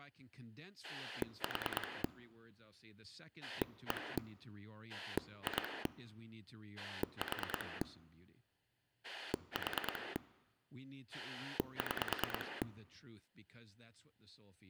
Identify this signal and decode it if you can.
Pulse dialling, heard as a rotary dial, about 9 pulses a second, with speech in English. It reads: 4 1 2 4 4 6